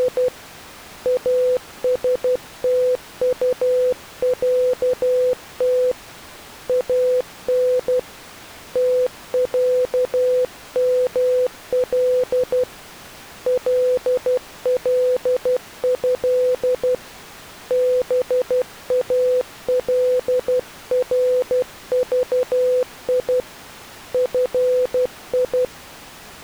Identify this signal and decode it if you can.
Morse code (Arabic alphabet), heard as a keyed tone, hand-sent with a paddle, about 12 wpm, 500 Hz. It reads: … استطعت ان تعمل لله بالرضي في